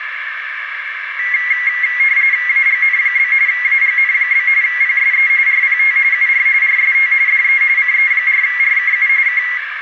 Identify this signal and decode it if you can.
RTTY (45.45 baud, 170 Hz shift), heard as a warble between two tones, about 2050 Hz centre, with radio static and a narrow filter. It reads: AGN? AGN? PSE RPT UR RST DE CE4RKU K